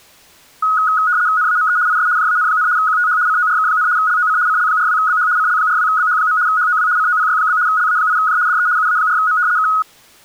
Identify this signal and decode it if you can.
RTTY (75 baud, 170 Hz shift), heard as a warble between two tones, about 1360 Hz centre. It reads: NAME IS JAN, QTH CORK, LOC CL42BH CL42BH. HOW COPY? LA8J DE UA4M K